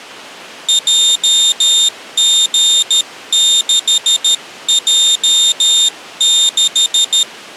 Morse code, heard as a high beeper, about 13 wpm, 3650 Hz. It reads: JG6J6